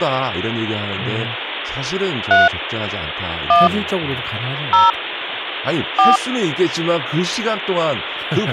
DTMF, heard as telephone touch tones, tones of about 170 ms, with phone line noise and speech in Korean. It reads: 3 1 0 4